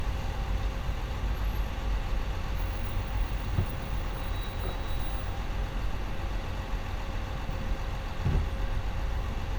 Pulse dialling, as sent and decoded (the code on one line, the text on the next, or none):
none